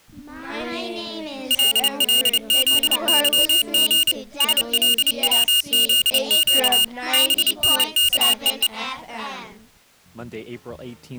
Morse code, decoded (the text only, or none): LLZYG SLWZQ BNKEE